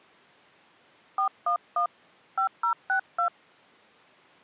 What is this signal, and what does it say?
DTMF, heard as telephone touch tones, dialled by hand, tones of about 100 ms. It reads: 411 5062